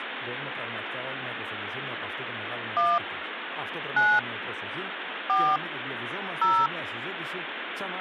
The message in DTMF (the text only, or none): 1 9 4 0